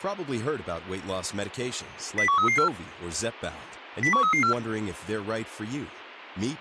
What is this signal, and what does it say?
Five-tone selective call (CCIR), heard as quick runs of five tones, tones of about 100 ms, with speech in English. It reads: 01334 01334